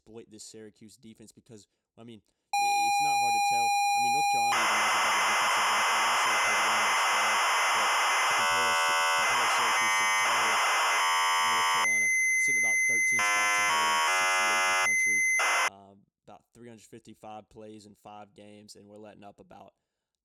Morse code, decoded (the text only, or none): none